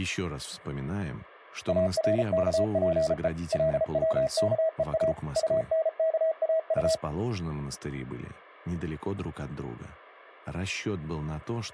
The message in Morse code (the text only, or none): ARKPE LWKEA UNKAU